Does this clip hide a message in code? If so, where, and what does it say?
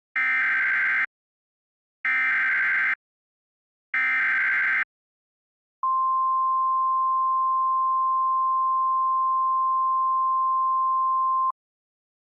Yes: Emergency Alert System (SAME) tones (header bursts, then the 1050 Hz attention tone) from 0.2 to 11.5 s, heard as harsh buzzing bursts, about 520.83 baud.